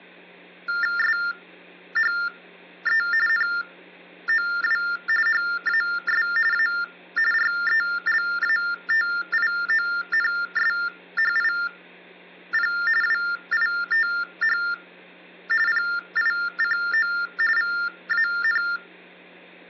TTY/TDD text telephone tones (45.45 baud Baudot), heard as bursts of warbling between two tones, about 400 Hz shift, 1600 Hz centre, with hum. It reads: SHE NOW HAS A RELATIONSHIP WITH PICO VAN